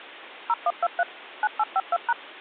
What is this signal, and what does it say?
DTMF, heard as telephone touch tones, dialled by machine, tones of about 40 ms. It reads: 0123 9852#